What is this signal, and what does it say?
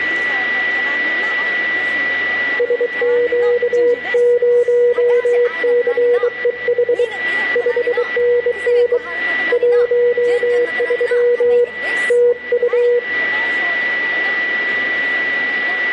Morse code, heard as a keyed tone, hand-sent with a bug key, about 23 wpm, 480 Hz, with a steady whistle near 1960 Hz and room echo. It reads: SQ0CEH 5NN 13 TU